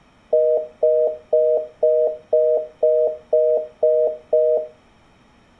Telephone call progress tone (North American plan), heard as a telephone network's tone, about 480, 620 Hz, 0.25 s on and 0.25 s off. Congestion tone.